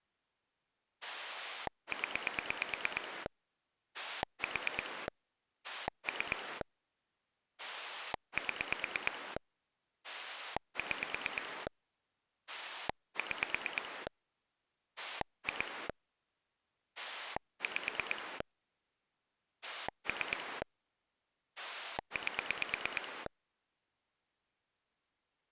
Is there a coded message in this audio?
Yes: pulse dialling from 1.0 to 23.3 s, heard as a rotary dial, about 9 pulses a second. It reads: 0 4 3 7 6 6 2 5 3 8